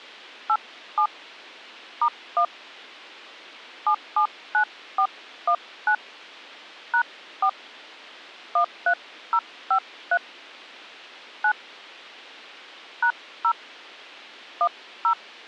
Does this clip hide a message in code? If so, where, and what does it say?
Yes: DTMF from 0.5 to 15.1 s, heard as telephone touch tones, dialled by hand, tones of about 70 ms. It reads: 87 *1 779419 #4 13053 9 #0 10